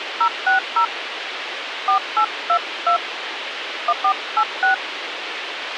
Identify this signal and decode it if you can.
DTMF, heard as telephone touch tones, dialled by hand, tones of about 90 ms, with radio hiss and a squelch burst at the end. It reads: 060 4822 1486